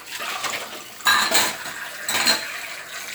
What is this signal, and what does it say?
Kitchen noise. There is no code.